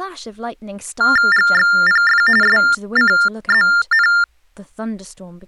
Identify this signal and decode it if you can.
TTY/TDD text telephone tones (45.45 baud Baudot), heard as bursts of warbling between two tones, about 400 Hz shift, 1600 Hz centre, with speech in English. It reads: GXPF SCZN